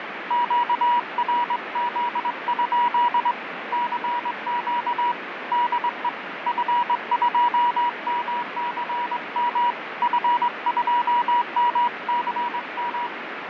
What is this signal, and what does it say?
Morse code, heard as a keyed tone, hand-sent with a straight key, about 22 wpm, 960 Hz, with radio static and fading. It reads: QRZ? CQ DE F2MCM F2MCM